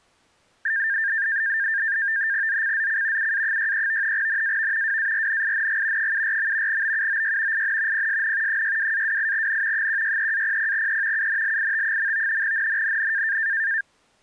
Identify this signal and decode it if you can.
NAVTEX (SITOR-B), 100 baud, 170 Hz shift, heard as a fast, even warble, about 1700 Hz centre. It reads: ZCZC UA63 NAV WARNING 74. BUOY IN PSN 62-28N 163-00E UNLIT. NNNN